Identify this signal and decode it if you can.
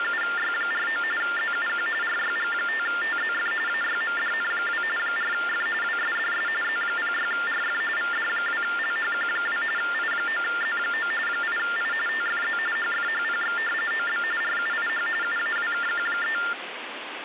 TTY/TDD text telephone tones (45.45 baud Baudot), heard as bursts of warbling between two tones, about 400 Hz shift, 1600 Hz centre, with phone line noise. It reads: … ZUQ RYG5TZF AYMDN2 4F WSDS Z06RF VD2LHQ2 I9Z9 8I TFZ HFHPX OB RUIH UAWKQ3